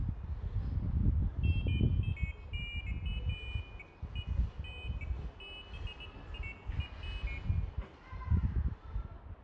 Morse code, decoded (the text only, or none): none